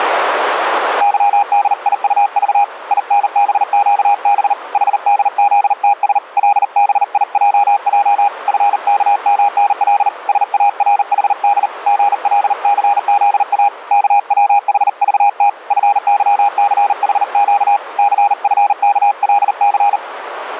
Morse code, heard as a keyed tone, hand-sent with a paddle, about 39 wpm, 810 Hz, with radio static and a narrow filter. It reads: YDIUV INBQB HDZTS LBIJJ FKMNL SARHD GLCZA KWHVT FYCHQ CFKLC